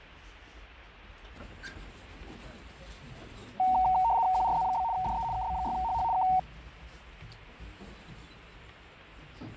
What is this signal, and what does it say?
RTTY (75 baud, 170 Hz shift), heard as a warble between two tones, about 830 Hz centre, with fading and the noise inside a lift. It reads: QRZ? DE KB6HH K